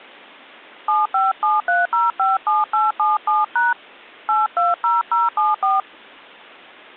DTMF, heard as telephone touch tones, dialled by hand, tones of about 170 ms. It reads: 7573057877# 820074